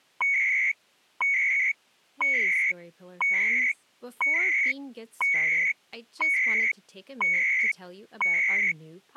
Radio time signal (CHU, Canada), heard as beeps and data bursts, one a second, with speech in English.